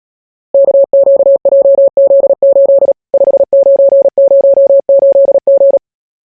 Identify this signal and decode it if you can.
Morse code, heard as a keyed tone, machine-sent, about 37 wpm, 550 Hz. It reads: KQJZ8 5908G